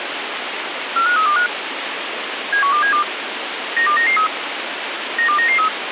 Five-tone selective call (CCIR), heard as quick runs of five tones, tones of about 100 ms, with radio hiss. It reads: 45325 71272 92993 92993